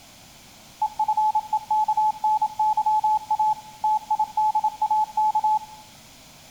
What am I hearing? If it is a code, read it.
Morse code, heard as a keyed tone, machine-sent, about 27 wpm, 860 Hz, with room echo. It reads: EFEKNYA TIDAK